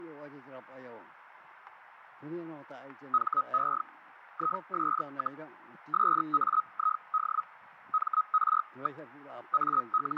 Hellschreiber (Feld-Hell, 122.5 baud), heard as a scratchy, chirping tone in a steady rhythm, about 1270 Hz, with radio static and static crashes. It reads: HE IS, SAID MR. …